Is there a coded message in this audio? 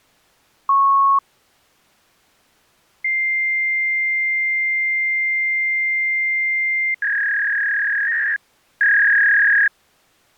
Yes: fax machine handshake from 0.7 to 9.7 s, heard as a beep, a long tone and a warble.